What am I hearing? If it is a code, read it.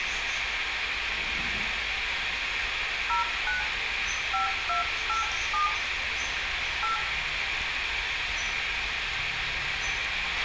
DTMF, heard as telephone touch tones, dialled by hand, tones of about 130 ms, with radio hiss, a squelch burst at the end and room echo. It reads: 09 5287 8